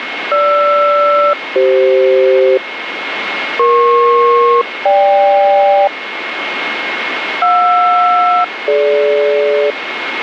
Aircraft SELCAL, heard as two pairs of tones, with radio static and a steady whistle near 2160 Hz. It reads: GR-CF EP-GK JR-DG